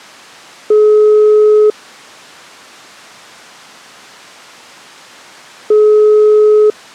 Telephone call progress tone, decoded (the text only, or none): ringback tone